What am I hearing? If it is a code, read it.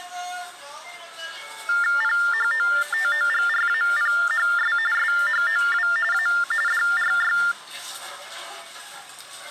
TTY/TDD text telephone tones (45.45 baud Baudot), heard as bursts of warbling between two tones, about 400 Hz shift, 1600 Hz centre, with the noise of a crowd indoors. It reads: PHOTOGRAPHS SHOW A DRY